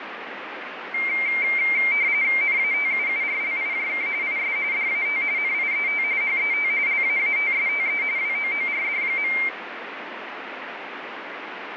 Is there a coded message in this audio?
Yes: RTTY (45.45 baud, 170 Hz shift) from 0.9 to 9.5 s, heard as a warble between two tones, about 2200 Hz centre, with radio static. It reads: NATUURLIJK IS DAT NIET HET LAATSTE WOORD.